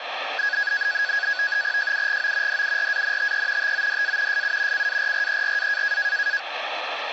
NAVTEX (SITOR-B), 100 baud, 170 Hz shift, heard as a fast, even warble, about 1550 Hz centre, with radio static. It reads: JUGO DURANTE TODA SU CARRERA